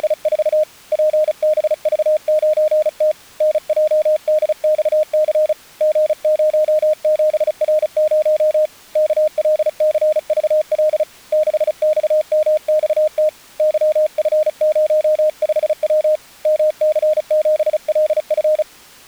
Morse code, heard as a keyed tone, hand-sent with a paddle, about 35 wpm, 620 Hz. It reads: … PBV9T NJDXC G07R0 KLCVL 6XMXT YF05W MC7LF